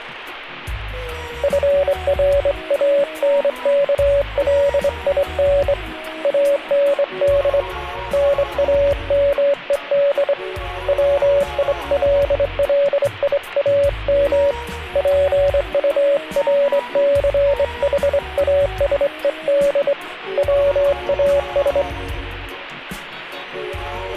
Morse code, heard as a keyed tone, hand-sent with a straight key, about 24 wpm, 570 Hz. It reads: FRANKLIN AND NAMED WILLIAM PURCHASED WAS